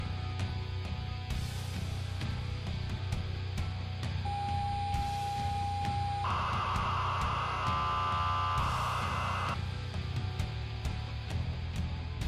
ZX Spectrum tape loading, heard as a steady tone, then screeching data.